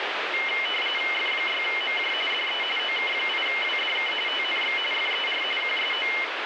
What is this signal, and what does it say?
RTTY (45.45 baud, 850 Hz shift), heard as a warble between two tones, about 2550 Hz centre, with radio static. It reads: F6MJ DE OK8WDK TNX FER QSO